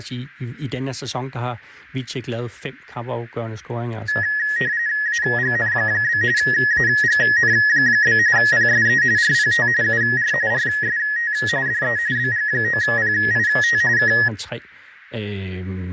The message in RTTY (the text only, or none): AGN? AGN? PSE RPT UR RST DE BG9PIT K